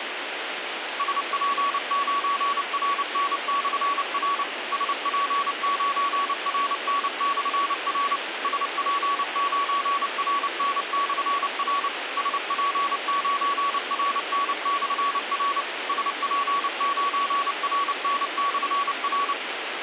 Morse code, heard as a keyed tone, machine-sent, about 29 wpm, 1130 Hz, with radio hiss. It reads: SP9RN/R SP9RN/R SP9RN/R SP9RN/R SP9RN/R